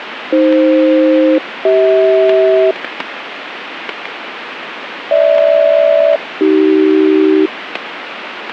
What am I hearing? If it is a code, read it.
Aircraft SELCAL, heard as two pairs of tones, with radio static and static crashes. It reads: AF-CH GH-AC